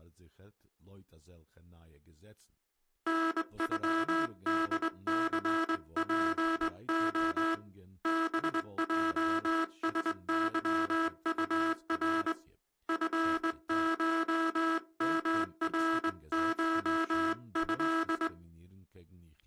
Morse code (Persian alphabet), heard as a buzzer, hand-sent with a straight key, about 21 wpm, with speech in German. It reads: نغدثپع بجسظطر فشمرشض